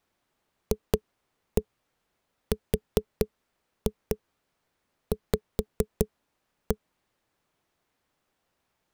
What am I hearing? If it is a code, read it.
Tap code, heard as knocks on a wall, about 4 knocks a second. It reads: FRV